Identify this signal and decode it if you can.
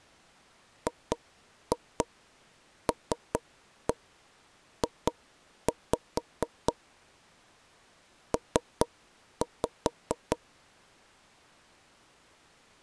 Tap code, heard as knocks on wood, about 4 knocks a second. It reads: GLJ P